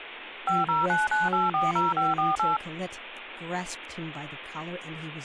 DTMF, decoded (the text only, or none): 5099840548